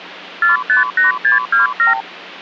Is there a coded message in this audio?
Yes: multi-frequency trunk signalling (R2, with the far end's replies) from 0.4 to 2.0 s, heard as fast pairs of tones, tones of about 140 ms. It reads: 458627